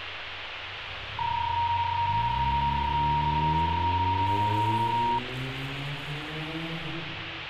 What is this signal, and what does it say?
PSK31 (31.25 baud), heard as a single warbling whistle, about 940 Hz, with radio static and street noise.